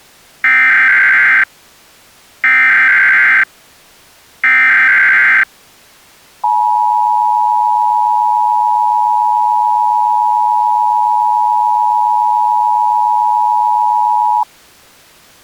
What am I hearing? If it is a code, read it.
Emergency Alert System (SAME) tones (header bursts, then the 853 and 960 Hz attention tone), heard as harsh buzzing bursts, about 520.83 baud.